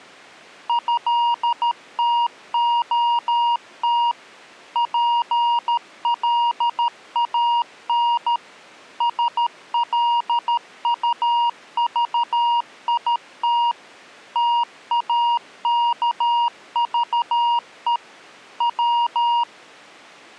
Morse code (Russian alphabet), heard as a keyed tone, machine-sent, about 13 wpm, 950 Hz. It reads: ЭТОТ ПЛАН СЛУЖИТ ТАКЖЕ В